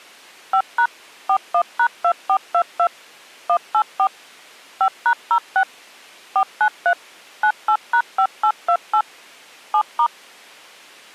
DTMF, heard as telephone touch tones, dialled by machine, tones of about 80 ms. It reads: 5# 41#2422 184 5#06 493 98#5828 7*